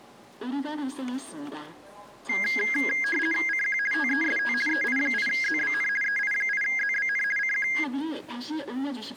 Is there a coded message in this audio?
Yes: RTTY (50 baud, 450 Hz shift) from 2.3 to 7.8 s, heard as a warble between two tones, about 1850 Hz centre, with the noise of a subway station. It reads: CQ TEST EI8ZBN EI8ZBN CQ